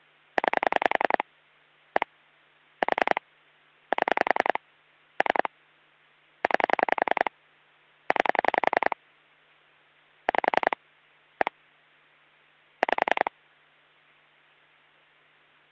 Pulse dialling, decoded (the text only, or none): 9 1 4 7 3 9 9 5 1 5